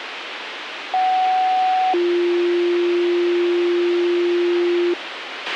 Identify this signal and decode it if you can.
Two-tone page, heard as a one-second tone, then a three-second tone, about 750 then 350 Hz, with radio hiss and a squelch burst at the end.